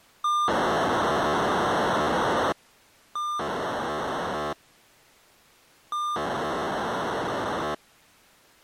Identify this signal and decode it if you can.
POCSAG pager data (2400 baud), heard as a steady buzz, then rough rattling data.